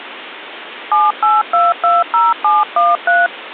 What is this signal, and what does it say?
DTMF, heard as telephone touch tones, dialled by hand, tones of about 190 ms, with phone line noise. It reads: 78220713